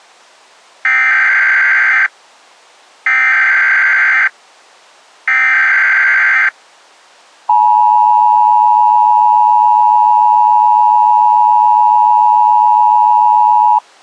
Emergency Alert System (SAME) tones (header bursts, then the 853 and 960 Hz attention tone), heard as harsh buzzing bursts, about 520.83 baud.